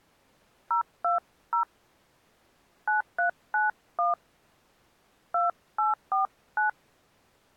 DTMF, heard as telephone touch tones, dialled by hand, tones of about 160 ms. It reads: 020 9391 2849